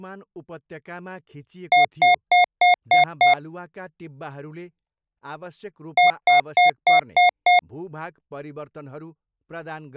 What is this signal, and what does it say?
Beep code, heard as beeps from a small speaker, played twice, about 720 Hz, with speech in Nepali. 6 short. In AMI BIOS tables: keyboard controller gate A20 failure; in Dell tables: video card failure.